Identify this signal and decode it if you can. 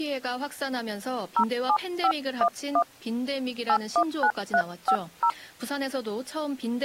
DTMF, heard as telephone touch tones, dialled by hand, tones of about 70 ms, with speech in Korean. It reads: 07511 819350